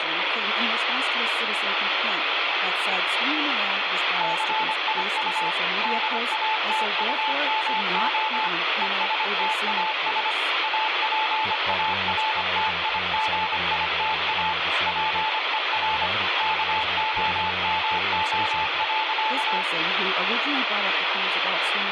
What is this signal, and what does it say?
Morse code, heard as a keyed tone, machine-sent, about 25 wpm, 870 Hz, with radio static. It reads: CIU DATUMO ESTAS APARTIGITA PER KOMO.